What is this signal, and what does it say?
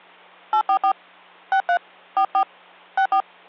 DTMF, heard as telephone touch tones, dialled by hand, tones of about 80 ms, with hum. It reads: 844 63 44 64